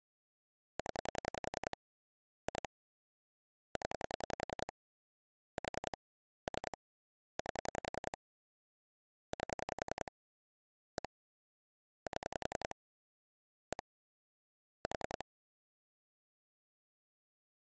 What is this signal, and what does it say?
Pulse dialling, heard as clicks on a phone line, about 10 pulses a second. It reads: 0 2 0 4 3 8 8 1 7 1 4